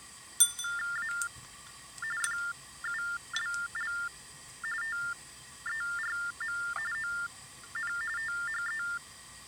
TTY/TDD text telephone tones (45.45 baud Baudot), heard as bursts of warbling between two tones, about 400 Hz shift, 1600 Hz centre, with kitchen noise. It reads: A FULL TERM ON THE